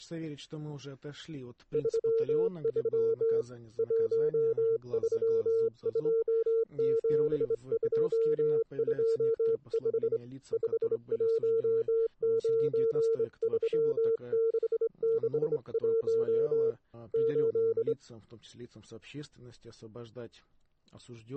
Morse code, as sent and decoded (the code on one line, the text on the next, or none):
...-- ...-- / .---- ...-- ..--- --... ..--- ..--- ..... / ..... .---- ----. ...-- -.... -.... .---- / ---..
33 1327225 5193661 8